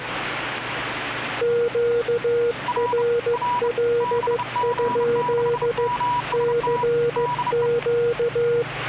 Morse code, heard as two keyed tones, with radio static and the noise inside a lift. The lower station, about 15 wpm, 470 Hz: QRL? CQ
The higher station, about 30 wpm, 980 Hz: R R BG6MST DE